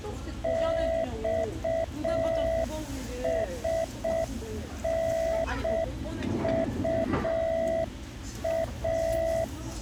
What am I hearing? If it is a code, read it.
Morse code, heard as a keyed tone, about 6 wpm, 660 Hz, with the noise of a crowd indoors. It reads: XSNUA